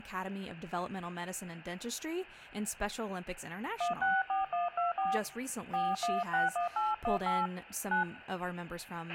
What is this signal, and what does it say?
DTMF, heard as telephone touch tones, dialled by hand, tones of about 170 ms, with a squelch burst at the end and speech in English. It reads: 164124 4161818 9